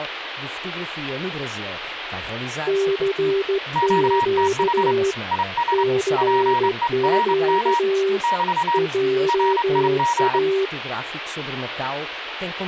Morse code, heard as two keyed tones, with radio static and speech in Portuguese. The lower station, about 16 wpm, 390 Hz: CQ CQ JA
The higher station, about 27 wpm, 950 Hz: QTH IS PERM <BT> RIG